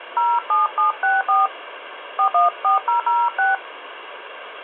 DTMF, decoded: 07764 414006

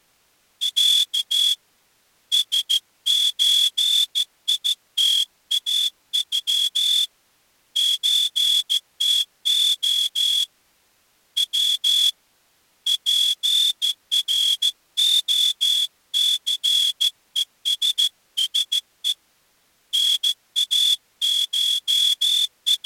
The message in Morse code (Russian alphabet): Я СЧИТАЮ ЧТО В ПРОЦЕССЕ …

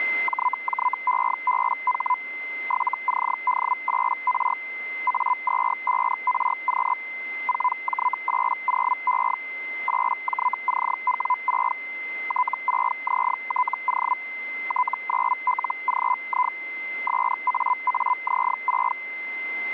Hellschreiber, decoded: JJEBH 7CD8R A25RQ 4J80E 8JCW6 T6ZTO T9LGI SAAZ6

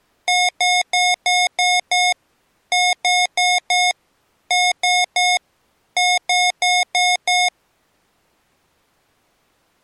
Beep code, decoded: 6-4-3-5

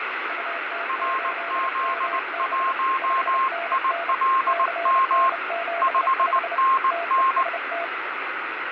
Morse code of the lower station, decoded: UT8MB 5NN CN75 TEST

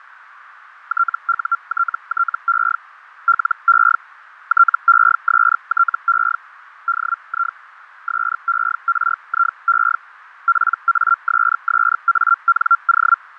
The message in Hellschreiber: TUTTE LE TESTE DI SERIE PASSANO

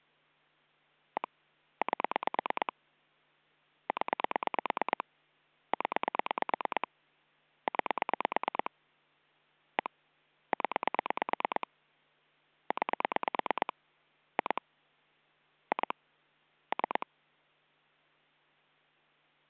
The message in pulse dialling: 1 8 0 0 9 1 0 9 2 2 3

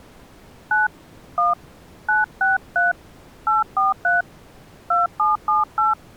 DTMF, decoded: 9 1 963 843 2778

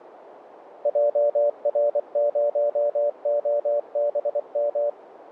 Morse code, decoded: JR0OBM

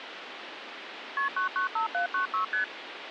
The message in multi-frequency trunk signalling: KP 995796 ST

